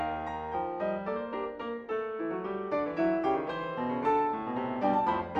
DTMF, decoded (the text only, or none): none